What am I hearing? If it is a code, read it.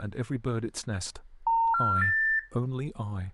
Telephone call progress tone (North American plan), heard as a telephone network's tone, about 910, 1370, 1800 Hz, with speech in English. Special information tone.